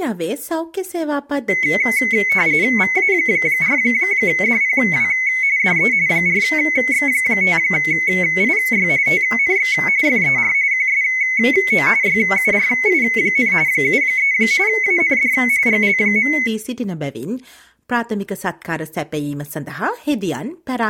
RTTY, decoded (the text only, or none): VA4DPW DE 4X5IY TNX FER QSO YURI, 73 AND GL.